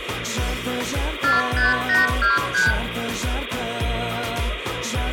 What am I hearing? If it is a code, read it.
Multi-frequency trunk signalling (R2, with the far end's replies), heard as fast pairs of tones, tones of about 160 ms, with phone line noise and room echo. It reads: 45823